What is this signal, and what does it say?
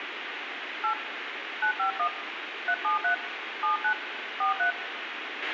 DTMF, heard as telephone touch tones, dialled by hand, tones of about 100 ms, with radio hiss, a squelch burst at the end and room echo. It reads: 8 951 373 79 43